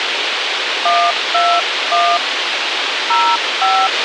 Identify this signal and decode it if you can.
DTMF, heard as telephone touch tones, dialled by hand, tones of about 260 ms, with radio hiss and a squelch burst at the end. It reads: 121 05